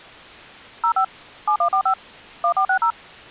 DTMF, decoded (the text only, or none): 05 7145 1460